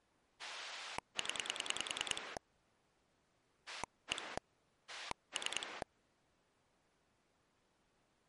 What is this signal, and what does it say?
Pulse dialling, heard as a rotary dial, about 10 pulses a second. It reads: 0 1 3